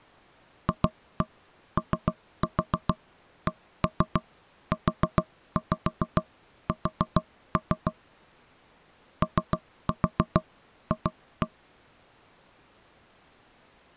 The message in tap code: FOCUS OF

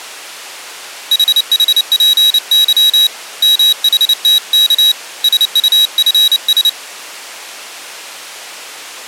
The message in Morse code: HHPY MHTK SUFS

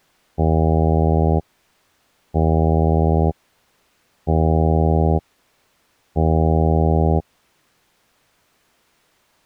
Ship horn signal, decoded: 4 short

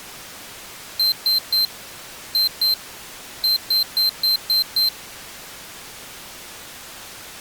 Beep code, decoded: 3-2-6

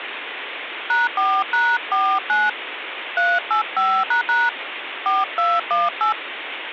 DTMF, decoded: #4#49 385## 4218

